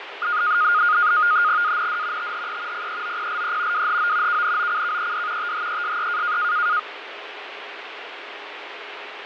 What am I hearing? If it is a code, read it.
NAVTEX (SITOR-B), 100 baud, 170 Hz shift, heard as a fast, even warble, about 1330 Hz centre, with radio static and fading. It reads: AND THE PEOPLE WHO KNOCKED THESE